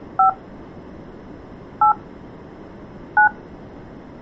DTMF, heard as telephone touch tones, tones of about 110 ms. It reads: 5 8 9